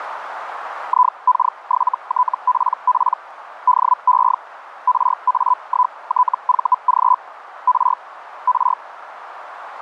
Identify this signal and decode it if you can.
Hellschreiber (Feld-Hell, 122.5 baud), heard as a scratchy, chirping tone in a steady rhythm, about 1000 Hz, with radio static and a narrow filter. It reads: IK7TPP DE RA1TVG R R